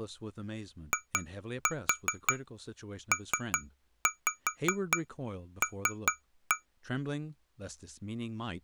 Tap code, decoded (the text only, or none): IPL